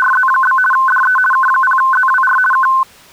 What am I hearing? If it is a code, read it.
RTTY (50 baud, 450 Hz shift), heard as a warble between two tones, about 1280 Hz centre. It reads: … DE K0ZWR K